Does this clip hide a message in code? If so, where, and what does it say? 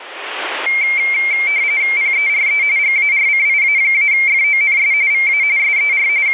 Yes: RTTY (45.45 baud, 170 Hz shift) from 0.7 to 6.3 s, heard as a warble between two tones, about 2200 Hz centre, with radio static. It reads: PERE GARCIA-FONS VA SER …